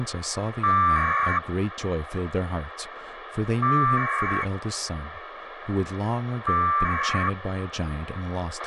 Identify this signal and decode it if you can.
Packet radio (AX.25, as in APRS), 1200 baud, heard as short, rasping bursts, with radio hiss, a squelch burst at the end and speech in English.